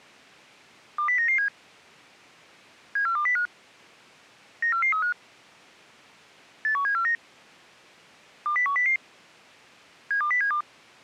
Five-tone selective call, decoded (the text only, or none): 20997 74205 94435 81749 20100 72072